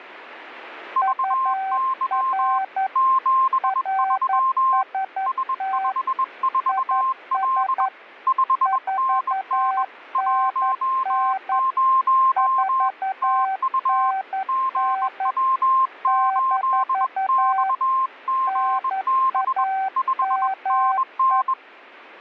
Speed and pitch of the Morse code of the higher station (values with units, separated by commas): 21 wpm, 1060 Hz